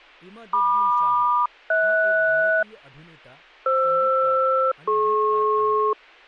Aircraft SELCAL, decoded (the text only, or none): MQ-HS FR-DP